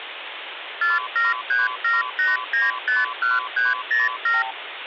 Multi-frequency trunk signalling (R2, with the far end's replies), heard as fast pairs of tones, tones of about 170 ms, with phone line noise. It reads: 47378951307